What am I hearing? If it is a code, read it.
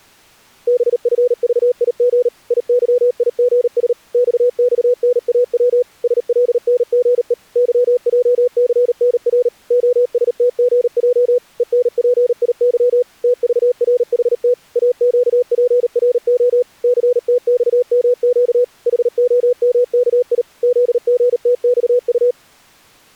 Morse code, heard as a keyed tone, machine-sent, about 38 wpm, 500 Hz. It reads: BFVIG IYIGS XXNAW SLNGE YJCNR OSTGJ ENPIY TVRHT AQPRO CTXMQ HOMKI ZGTXU